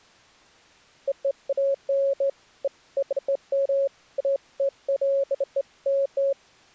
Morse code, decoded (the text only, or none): none